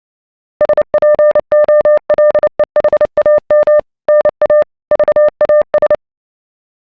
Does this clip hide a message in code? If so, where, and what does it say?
Yes: Morse code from 0.5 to 6.0 s, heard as a keyed tone, machine-sent, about 29 wpm, 600 Hz. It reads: SPOLEHAM NA VAS